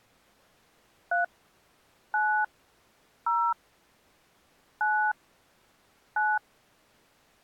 DTMF, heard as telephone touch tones, dialled by hand, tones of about 220 ms. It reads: 3 9 0 9 9